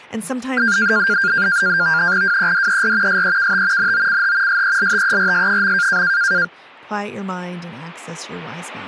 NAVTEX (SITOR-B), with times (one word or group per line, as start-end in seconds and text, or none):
2.2-3.2 WEDER
3.1-3.9 SEKT
3.8-4.6 NOCH
4.5-6.0 SELTERS.